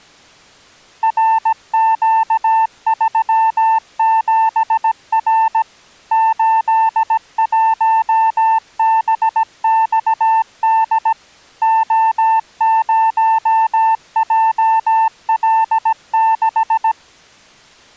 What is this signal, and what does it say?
Morse code, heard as a keyed tone, machine-sent, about 17 wpm, 890 Hz. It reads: RQ37R 81BXD O0JL6